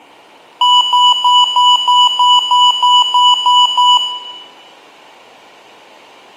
Beep code, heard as beeps from a small speaker, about 990 Hz, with room echo. 11 short. In AMI BIOS tables: cache memory error.